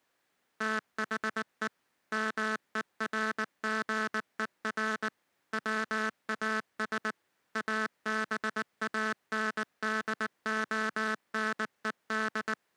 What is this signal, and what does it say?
Morse code, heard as a buzzer, machine-sent, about 19 wpm. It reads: THE MERGER WAS ABANDONED